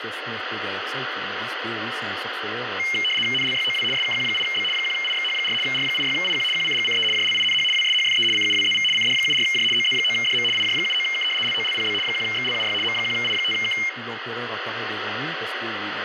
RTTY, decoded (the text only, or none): NLYOW SKQ8B 1IXH4 R86IQ QCGCE JLINH WSHFE CUWZV CD74J OZ9DM IJ79K LOLPB 1XLUY M1I5K